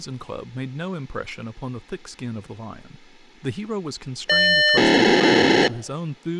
POCSAG pager data (1200 baud), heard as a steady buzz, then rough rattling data, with speech in English.